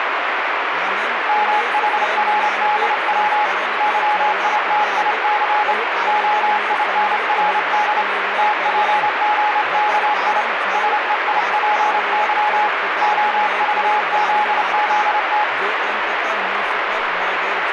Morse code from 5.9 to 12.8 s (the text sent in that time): OINRD TPGKI SEIPY